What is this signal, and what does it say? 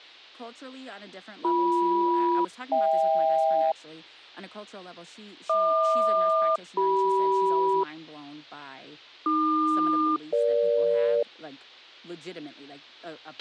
Aircraft SELCAL, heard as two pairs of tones, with a squelch burst at the end and speech in English. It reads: BM-HK HQ-CM AQ-EG